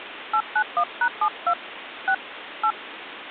DTMF, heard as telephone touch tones, dialled by hand, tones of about 70 ms, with phone line noise. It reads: 891#72 6 8